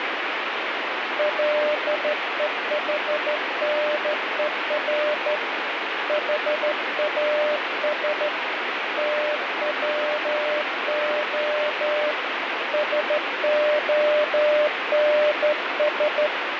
Morse code, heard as a keyed tone, hand-sent with a straight key, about 13 wpm, 600 Hz, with heavy radio static. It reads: LEHNER HAS TWO SONS